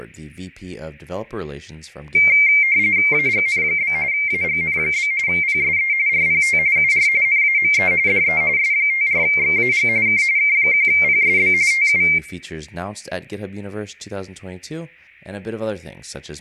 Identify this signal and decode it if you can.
RTTY (45.45 baud, 170 Hz shift), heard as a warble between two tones, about 2200 Hz centre, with speech in English. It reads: AGN? AGN? PSE RPT UR NAME DE S54XAG K K1PSB TU